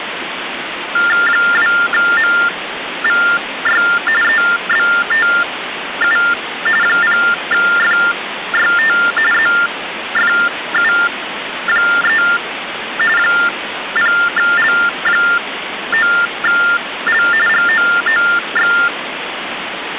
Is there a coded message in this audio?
Yes: TTY/TDD text telephone tones (45.45 baud Baudot) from 1.0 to 18.9 s, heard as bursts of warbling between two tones, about 400 Hz shift, 1600 Hz centre, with phone line noise. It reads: 2MVY EBTU 0FYT ZFU3 0L9L GOOX